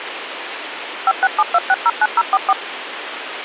DTMF, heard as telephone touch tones, dialled by machine, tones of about 40 ms, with phone line noise. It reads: 5672609044